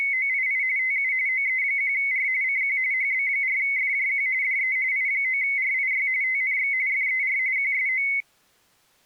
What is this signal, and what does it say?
RTTY (45.45 baud, 170 Hz shift), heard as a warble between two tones, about 2150 Hz centre. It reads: … TU OE1R CQ HB4FJQ DE I9RIY TNX FER QSO